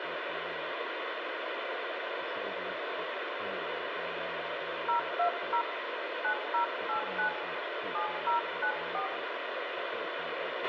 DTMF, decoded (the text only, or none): 020 9089 7094